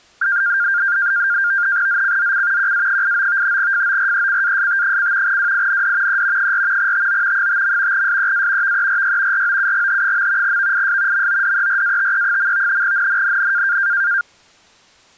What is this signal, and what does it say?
NAVTEX (SITOR-B), 100 baud, 170 Hz shift, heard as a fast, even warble, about 1500 Hz centre. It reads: ZCZC QA89 FORECAST: WIND E 4 TO 5. SEA VERY ROUGH. VIS MODERATE. NNNN